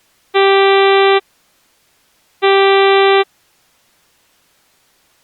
Ship horn signal, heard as a ship's horn, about 390 Hz. 2 short. At sea: I am altering course to port.